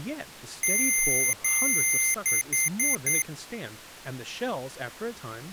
Beep code, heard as beeps from a small speaker, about 2100 Hz, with speech in English. 2 long, 4 short.